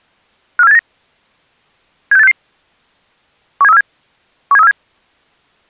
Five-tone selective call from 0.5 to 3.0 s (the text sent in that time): 54789 76866